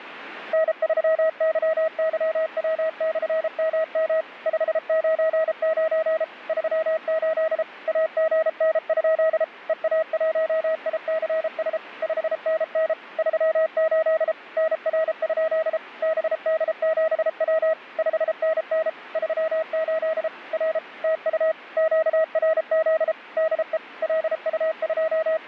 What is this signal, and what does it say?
Morse code, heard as a keyed tone, machine-sent, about 33 wpm, 640 Hz. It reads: N3YYW/MM 599 38 AGN? EA1ICS 5NN 38 NR? BD7W 5NN 38 R TU QRZ DE …